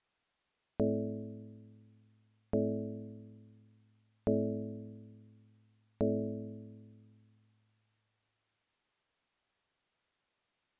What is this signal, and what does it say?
Clock strike, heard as a bell. 4. Four o'clock.